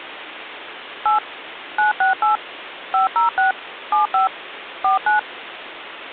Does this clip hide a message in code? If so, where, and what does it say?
Yes: DTMF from 1.1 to 5.2 s, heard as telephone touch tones, dialled by machine, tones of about 130 ms, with phone line noise. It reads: 8 968 506 75 49